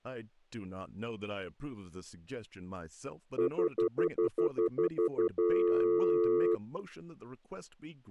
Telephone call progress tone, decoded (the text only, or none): stutter dial tone